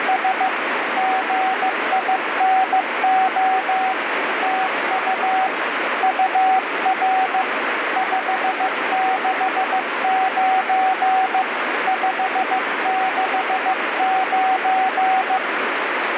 Morse code, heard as a keyed tone, hand-sent with a paddle, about 15 wpm, 760 Hz, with heavy radio static. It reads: … GINO TU UR 569 569